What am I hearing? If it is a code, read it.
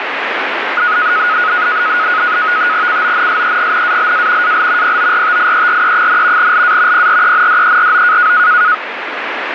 NAVTEX (SITOR-B), 100 baud, 170 Hz shift, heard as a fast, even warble, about 1360 Hz centre, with radio static. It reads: CONSEGNALA AL PORTIERE, LA PRENDERO